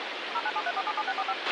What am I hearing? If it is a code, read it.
DTMF, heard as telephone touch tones, dialled by machine, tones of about 50 ms, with radio hiss and a squelch burst at the end. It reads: 0973477645